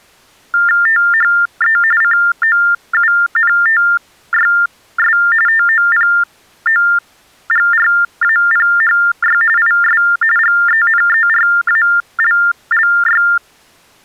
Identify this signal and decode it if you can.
TTY/TDD text telephone tones (45.45 baud Baudot), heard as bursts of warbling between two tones, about 400 Hz shift, 1600 Hz centre. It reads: THE COUNTYS TOPOGRAPHY IS GENERALLY